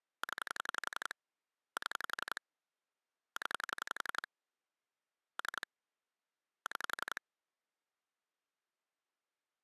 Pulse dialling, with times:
0.2-1.1 0
1.8-2.4 7
3.4-4.3 0
5.4-5.7 3
6.7-7.2 6

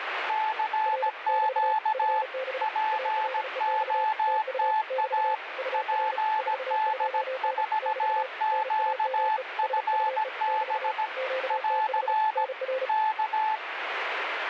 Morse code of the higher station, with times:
0.3-2.2 CQ
2.6-5.3 POTA
5.7-11.1 PD4QFB
11.5-12.4 <AR>
12.9-13.6 K

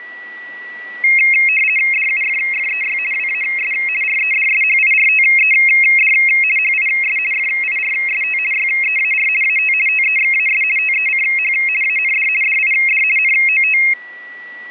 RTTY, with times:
1.9-3.0 DUFFEY
3.1-3.7 WAS
4.0-6.1 REDSHIRTED
6.6-7.2 HIS
7.3-8.4 FIRST
8.5-9.3 YEAR
9.4-9.7 AT
9.9-10.6 TEXAS
10.8-11.5 TECH
11.8-12.3 AND
12.4-13.0 DID
13.2-13.8 NOT

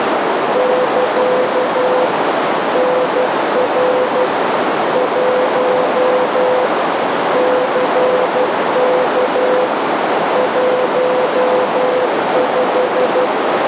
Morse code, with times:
0.6-2.1 <KA>
2.8-4.3 NR
5.0-6.7 1
7.4-9.7 CK
10.4-13.3 15

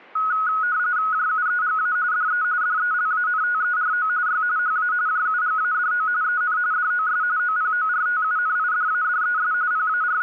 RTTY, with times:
1.1-2.0 JUEGA
2.1-2.4 DE
2.6-4.1 DELANTERO
4.3-4.4 Y
4.6-4.9 HA
5.1-6.1 JUGADO
6.2-6.6 EN
6.7-7.2 DOS
7.4-9.5 OPORTUNIDADES
9.7-10.2 …

